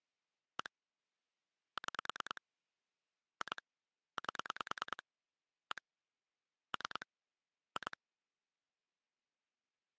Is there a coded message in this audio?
Yes: pulse dialling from 0.6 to 7.9 s, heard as clicks on a phone line, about 9 pulses a second. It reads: 1 6 2 8 1 3 2